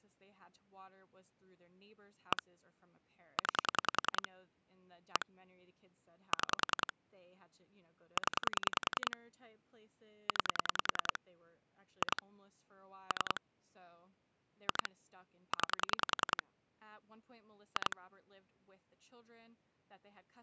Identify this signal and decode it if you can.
Pulse dialling, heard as clicks on a phone line, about 10 pulses a second, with speech in English. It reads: 1 9 1 6 0 9 2 3 2 9 2